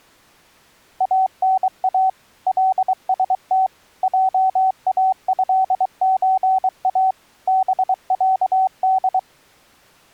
Morse code (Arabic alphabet), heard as a keyed tone, machine-sent, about 23 wpm, 760 Hz. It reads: انا لست جاهزا بعد